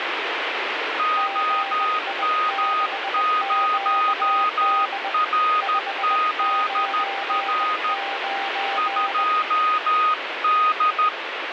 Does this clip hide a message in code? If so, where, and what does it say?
Yes: Morse code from 0.9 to 11.1 s, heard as two keyed tones, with radio static. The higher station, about 13 wpm, 1240 Hz: OM0RZR 2D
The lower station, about 20 wpm, 790 Hz: GI6QD 599